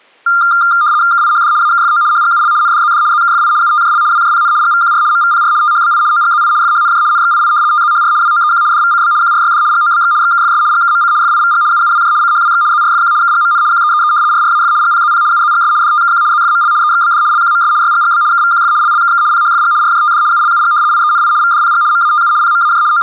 RTTY (75 baud, 170 Hz shift), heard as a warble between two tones, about 1300 Hz centre. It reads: KIHD AKFO HGUL NDZD ZKFI UTJL WJPN GVQR MVPR THBI OGZI FHNJ NXII TZHR WOEQ DVCB QRYD GOBX XKFS GKMC FIVG UUWJ CHWX ZRFQ KGMN QEEE RRAF GPZP UZGS DTKQ ZFML EXBD LQMS YGGB KVQF LLKK PHFG RJTD ULUG IENI VDPG MATU PMAJ …